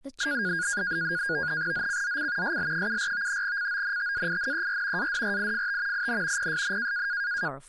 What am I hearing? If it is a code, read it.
NAVTEX (SITOR-B), 100 baud, 170 Hz shift, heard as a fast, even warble, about 1550 Hz centre, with speech in English. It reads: ZCZC SL74 CONTAINER ADRIFT IN PSN